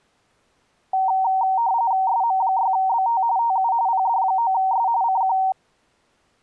RTTY (45.45 baud, 170 Hz shift), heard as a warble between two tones, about 850 Hz centre. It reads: SM6BT TU PD9S CQ